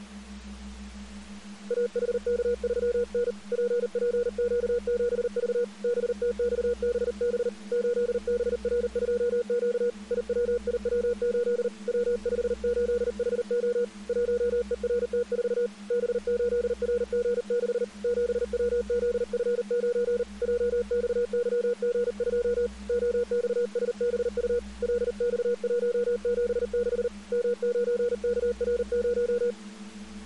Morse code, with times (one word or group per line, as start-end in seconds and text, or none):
1.7-3.3 AHK3N
3.5-5.6 PPQ7V
5.8-7.5 BTXBB
7.7-9.9 8BR2Q
10.1-11.7 IWIW8
11.9-13.8 W58HO
14.1-15.7 1ERT4
15.9-17.8 B8RG6
18.0-20.2 7WZF9
20.4-22.7 JXYG2
22.9-24.6 OXSBU
24.8-27.1 LX176
27.3-29.5 M9KR0